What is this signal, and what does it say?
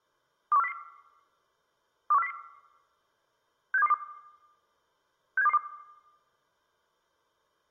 Five-tone selective call (EEA), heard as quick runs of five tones, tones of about 40 ms, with room echo. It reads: 21400 21400 67222 67222